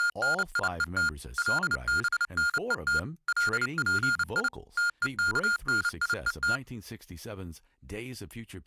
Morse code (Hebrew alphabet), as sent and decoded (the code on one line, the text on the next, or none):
… / .-.. -... -. . - / .-.. .--. .. / - . -.- -. .. . -
… לבנות לפי תוכניות